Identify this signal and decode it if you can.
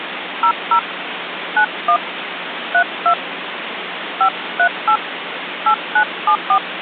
DTMF, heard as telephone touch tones, dialled by hand, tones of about 80 ms, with phone line noise. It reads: 00 91 32 538 8974